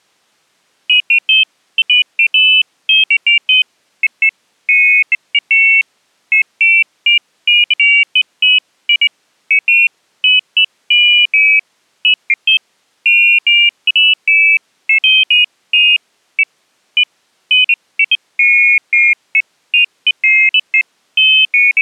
Pairs of high tones at irregular times. There is no code.